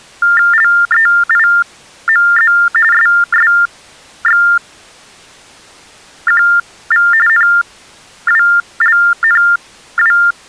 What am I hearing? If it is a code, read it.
TTY/TDD text telephone tones (45.45 baud Baudot), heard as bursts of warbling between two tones, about 400 Hz shift, 1600 Hz centre. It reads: LEIMZ SSXQV NWLNW